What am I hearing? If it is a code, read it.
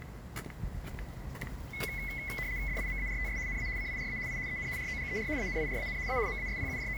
RTTY (75 baud, 170 Hz shift), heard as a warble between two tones, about 2100 Hz centre, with the noise of a park. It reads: DIMARTS NA CIRA I EN ROGER ANIRAN A …